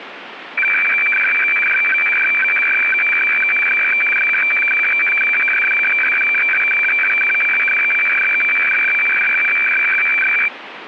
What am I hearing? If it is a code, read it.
Weather fax (radiofax), 120 lines a minute, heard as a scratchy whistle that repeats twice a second, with radio static.